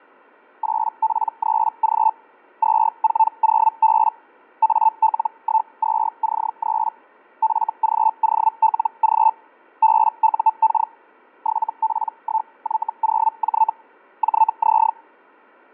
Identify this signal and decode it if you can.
Hellschreiber (Feld-Hell, 122.5 baud), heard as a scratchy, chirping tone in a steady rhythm, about 880 Hz, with fading. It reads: 8P3G 240B AL12C3 FGOLG BUK 7P1Y0J JZ